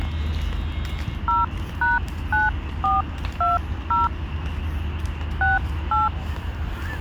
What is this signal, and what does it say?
DTMF, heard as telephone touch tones, dialled by hand, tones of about 170 ms, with the noise of a park. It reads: 0#9420 68